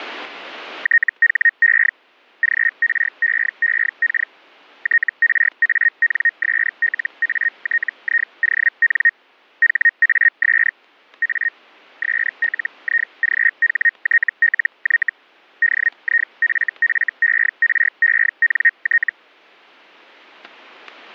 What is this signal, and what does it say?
Hellschreiber (Feld-Hell, 122.5 baud), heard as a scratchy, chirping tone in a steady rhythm, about 1850 Hz, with static crashes. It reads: THE GREEK TRANSLATION HAS A SLIGHTLY DIFFERENT